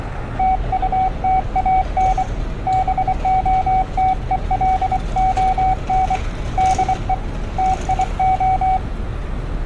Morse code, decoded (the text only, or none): TUTAN BOTELON DE TIO